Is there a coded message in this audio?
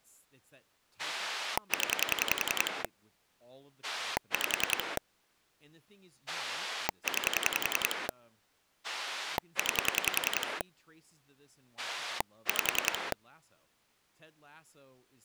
Yes: pulse dialling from 1.0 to 13.1 s, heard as a rotary dial, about 10 pulses a second, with speech in English. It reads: 0 5 9 9 5